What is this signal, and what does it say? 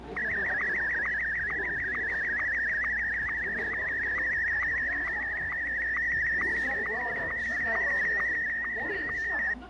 SSTV (slow-scan television), Martin M1, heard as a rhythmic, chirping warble, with a steady whistle near 720 Hz and the noise of a cafe.